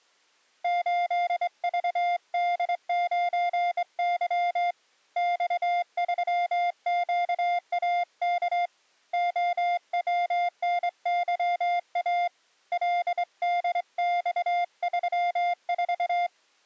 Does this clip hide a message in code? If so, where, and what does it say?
Yes: Morse code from 0.6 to 16.3 s, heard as a keyed tone, hand-sent with a straight key, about 23 wpm, 700 Hz. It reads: 8VD9Y X3QAK OWNYA LDX34